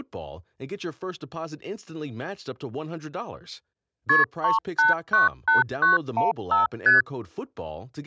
Multi-frequency trunk signalling (R1, as on North American trunks), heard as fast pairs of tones, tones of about 150 ms, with speech in English. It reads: KP 3898915 ST